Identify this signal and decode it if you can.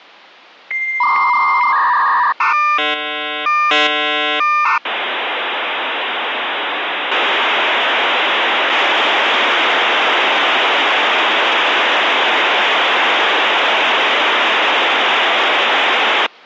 Dial-up modem handshake (V.34 or later), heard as a whistle, warbles, then hiss.